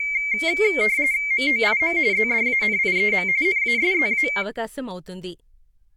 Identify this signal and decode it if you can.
RTTY (45.45 baud, 170 Hz shift), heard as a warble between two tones, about 2200 Hz centre, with speech in Telugu. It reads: MOIM ZDANIEM NASZA